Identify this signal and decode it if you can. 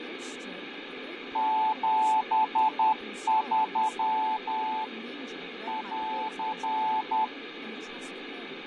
Morse code, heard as a keyed tone, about 10 wpm, 870 Hz, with radio static, fading and speech in English. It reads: 73 <AR>